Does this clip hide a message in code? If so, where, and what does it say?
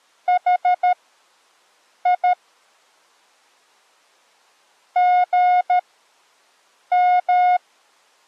Yes: Morse code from 0.2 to 7.6 s, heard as a keyed tone, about 13 wpm, spaced as for 6 wpm, 720 Hz. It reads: HI GM